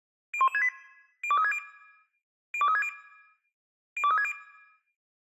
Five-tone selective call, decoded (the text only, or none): 01168 02360 02360 02360